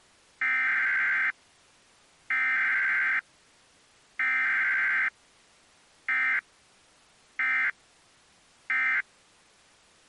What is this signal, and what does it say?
Emergency Alert System (SAME) tones (header bursts, then end-of-message bursts), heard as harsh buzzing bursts, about 520.83 baud.